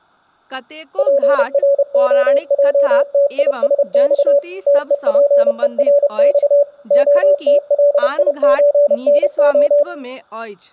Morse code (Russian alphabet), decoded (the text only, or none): ПРОЙТИСЬ ТЕПЕРЬ ОТЛИЧНО